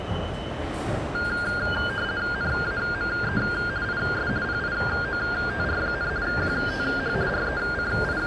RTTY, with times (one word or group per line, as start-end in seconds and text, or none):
2.3-3.4 NAME
3.8-4.3 IS
4.4-6.1 PIOTR,
6.2-7.1 QTH
7.3-8.3 …